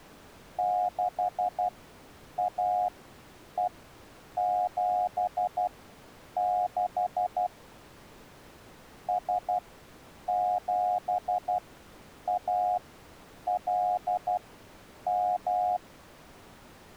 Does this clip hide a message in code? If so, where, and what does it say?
Yes: Morse code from 0.5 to 15.8 s, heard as a keyed tone, machine-sent, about 12 wpm, spaced as for 8 wpm, 720 Hz. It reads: 6AE76 S7ALM